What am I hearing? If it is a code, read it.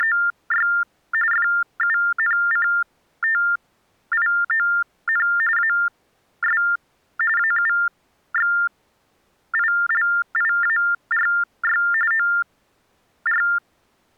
TTY/TDD text telephone tones (45.45 baud Baudot), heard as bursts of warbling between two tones, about 400 Hz shift, 1600 Hz centre. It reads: … FUNCTION AS AUXILIARY OR